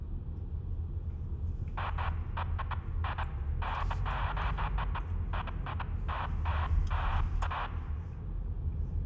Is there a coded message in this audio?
No, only bursts of noise, with room echo and the noise inside a car.